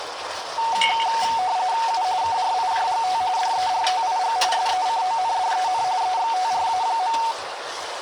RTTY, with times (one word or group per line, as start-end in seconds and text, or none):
1.9-2.0 U
2.2-3.2 KRIJGT
3.4-4.4 DERTIG
4.5-5.8 SECONDEN
6.0-7.2 EXTRA.